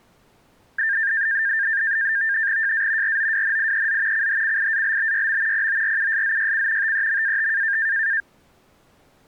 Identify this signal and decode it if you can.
NAVTEX (SITOR-B), 100 baud, 170 Hz shift, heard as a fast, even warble, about 1700 Hz centre. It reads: JA ROWNIEZ CHCIALBYM PORUSZYC TEMAT